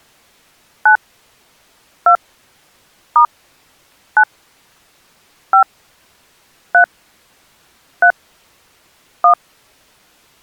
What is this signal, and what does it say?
DTMF, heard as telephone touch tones, dialled by hand, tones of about 80 ms. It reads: 9 2 * 9 5 3 3 1